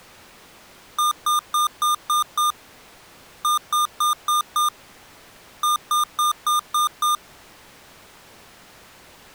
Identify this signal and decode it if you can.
Beep code, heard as beeps from a small speaker, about 1210 Hz. 6-5-6.